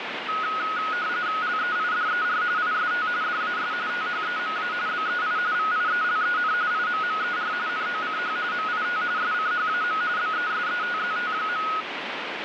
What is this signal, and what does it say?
RTTY (45.45 baud, 170 Hz shift), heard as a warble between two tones, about 1360 Hz centre, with radio static. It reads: LEIDER IST DAS THEMA BEI VIELEN IMMER NOCH MIT SCHAM BESETZT.